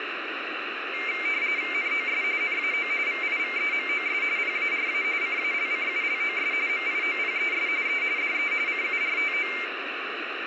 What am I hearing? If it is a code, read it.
RTTY (45.45 baud, 170 Hz shift), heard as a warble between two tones, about 2200 Hz centre, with radio static. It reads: NOS NAO VIVEMOS PARA CALCULOS MIOPES E DE CURTO